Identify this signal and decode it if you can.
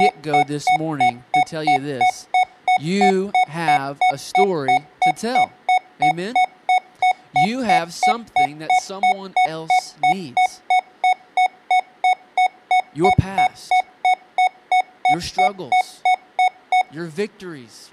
Evenly repeated beeps, with speech in English. There is no code.